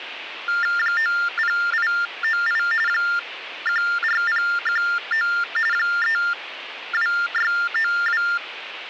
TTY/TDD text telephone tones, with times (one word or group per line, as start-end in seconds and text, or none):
0.8-2.6 90898
2.9-5.3 14019
5.7-8.2 32692